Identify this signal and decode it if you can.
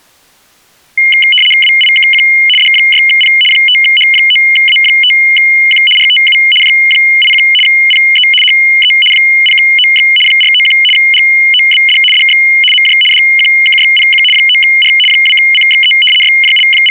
RTTY (75 baud, 850 Hz shift), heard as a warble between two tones, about 2550 Hz centre. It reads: WIKQ D6P 5H9A5Q RTU J81 PE HE 0OX 491 GOBD DX MJ DQKYPQ 9R 2CXE …